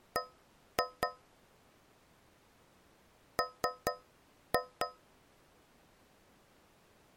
Tap code, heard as taps on a metal pipe, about 4 knocks a second. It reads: B M